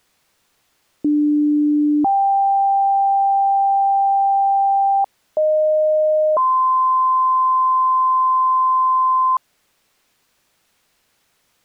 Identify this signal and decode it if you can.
Two-tone page, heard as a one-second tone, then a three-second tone, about 300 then 790 Hz, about 620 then 1040 Hz.